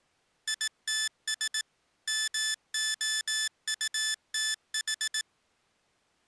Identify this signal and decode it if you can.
Morse code, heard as electronic beeps, machine-sent, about 18 wpm, 1750 Hz. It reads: ITS MOUTH